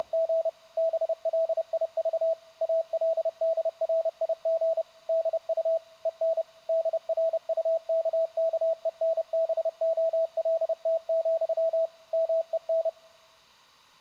Morse code, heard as a keyed tone, machine-sent, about 30 wpm, 650 Hz. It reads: … BLIV ALDRIG DU EN DRUKKENBOLT, MEN